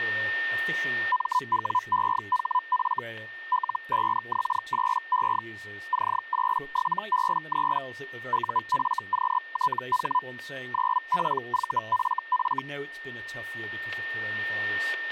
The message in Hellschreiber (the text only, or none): MWEHF L5X8E C87B3 UFQTH 9PVFF